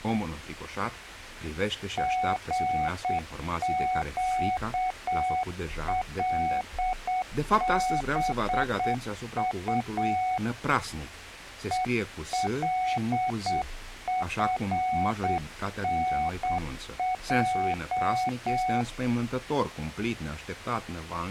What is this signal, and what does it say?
Morse code, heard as a keyed tone, hand-sent with a straight key, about 8 wpm, 740 Hz. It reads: GQLBU ELFNJ